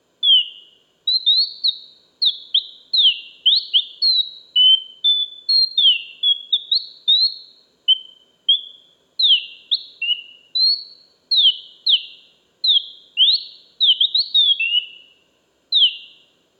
Bird-like chirps, with room echo. There is no code.